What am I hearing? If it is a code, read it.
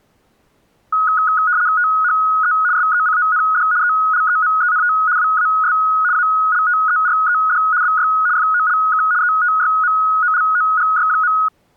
RTTY (75 baud, 170 Hz shift), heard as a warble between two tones, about 1360 Hz centre. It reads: THE SECOND ELEMENT WAS ALTERED BY FOLK ETYMOLOGY.